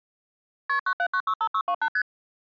Multi-frequency trunk signalling (R1, as on North American trunks), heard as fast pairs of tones, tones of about 70 ms. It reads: KP 97965628 ST